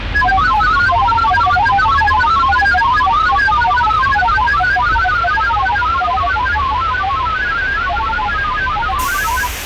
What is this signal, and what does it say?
Multi-tone FSK (Olivia or MFSK type), about 1000 Hz wide, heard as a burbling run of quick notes, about 31.25 baud, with radio static and the noise inside a bus.